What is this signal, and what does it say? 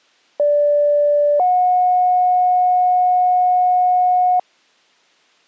Two-tone page, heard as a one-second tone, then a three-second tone, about 580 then 730 Hz.